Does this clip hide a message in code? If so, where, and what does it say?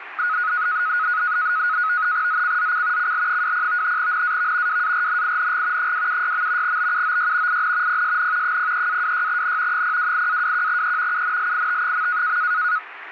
Yes: NAVTEX (SITOR-B), 100 baud, 170 Hz shift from 0.2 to 12.8 s, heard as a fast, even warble, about 1360 Hz centre, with radio static. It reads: ZCZC CL20 NAV WARNING 276. BUOY IN PSN 03-26N 028-21E UNLIT.